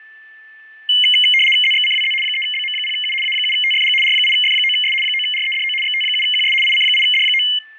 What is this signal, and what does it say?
RTTY (75 baud, 850 Hz shift), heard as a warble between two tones, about 2550 Hz centre, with fading and a steady whistle near 1760 Hz. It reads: ZXCWZ 3BM0U A7TFG R8F9S 9REDO XT7QS IC8D9